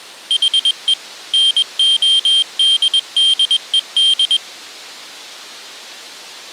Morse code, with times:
0.3-0.9 HE
1.3-4.4 NODDED

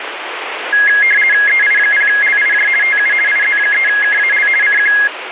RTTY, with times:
1.5-2.7 EI0LIJ
2.8-3.1 TU
3.3-4.5 IZ3KAL
4.6-4.9 CQ

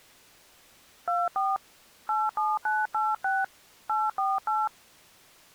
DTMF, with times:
1.1-1.6 24
2.1-3.4 87986
3.9-4.7 848

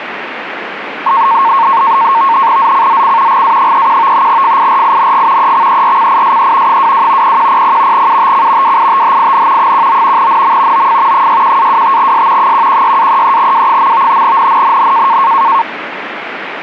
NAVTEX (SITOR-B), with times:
2.6-3.4 ZCZC
3.3-4.3 GA31
4.3-5.5 FIRING
5.4-6.8 EXERCISE
6.7-7.4 22
7.2-8.1 0100
7.9-8.8 UTC
8.6-9.7 WITHIN
9.6-10.3 19
10.2-10.9 NM
10.7-11.3 OF
11.1-12.5 61-25S
12.4-14.2 116-33W.
14.2-15.2 NNNN

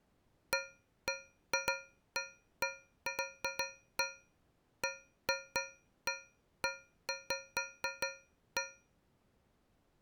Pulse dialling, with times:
none

